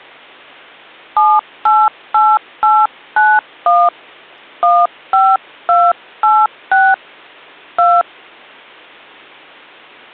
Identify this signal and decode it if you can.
DTMF, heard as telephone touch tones, dialled by hand, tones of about 230 ms. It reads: 788891 15286 2